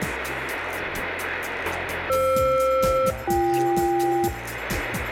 Aircraft SELCAL, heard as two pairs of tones, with radio static. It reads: FR-BK